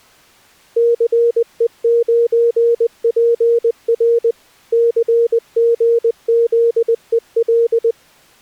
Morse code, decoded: CE9PR CGZEL

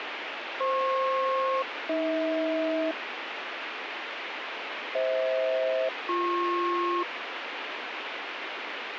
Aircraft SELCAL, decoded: FP-AH FH-BP

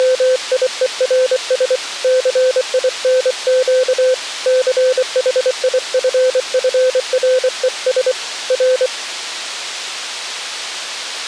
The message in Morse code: … CINQ CHIFFRES R

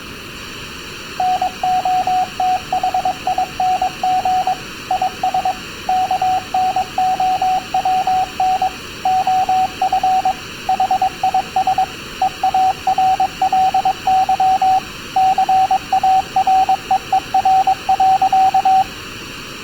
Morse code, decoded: NOTHING IS KNOWN OF HIS EARLY CAREER.

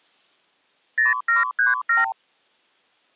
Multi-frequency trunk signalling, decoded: 0737

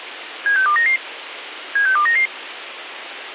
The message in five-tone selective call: 76299 76299

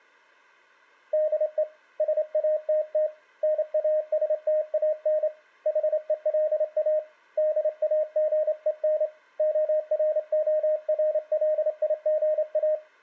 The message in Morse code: DE SATT NASTAN HELA DAGEN ORORLIGA

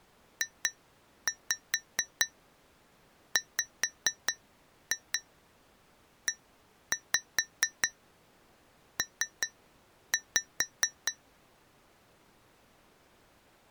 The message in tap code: JWEP

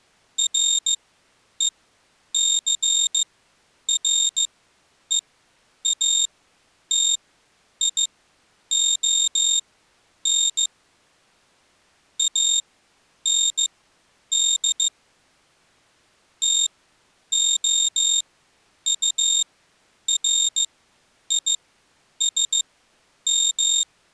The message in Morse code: RECREATION AND TOURISM

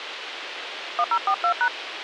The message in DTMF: 1042#

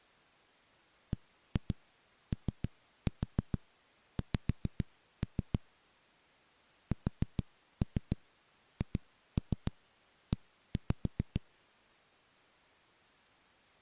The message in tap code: BOX SHE

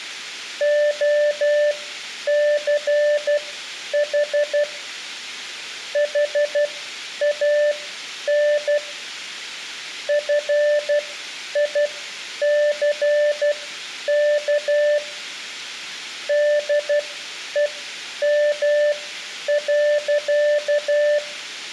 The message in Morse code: OCH HAN FICK DEM.

